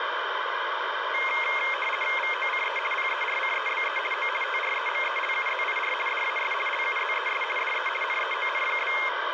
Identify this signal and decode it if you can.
RTTY (50 baud, 450 Hz shift), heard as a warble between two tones, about 2350 Hz centre, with radio static. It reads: VOCE PERCEBE O TREMELUZIR DAS LUZES DE NEON?